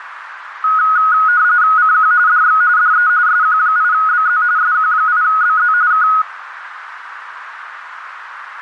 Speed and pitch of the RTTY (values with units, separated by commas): 45.45 baud, 170 Hz shift, 1360 Hz centre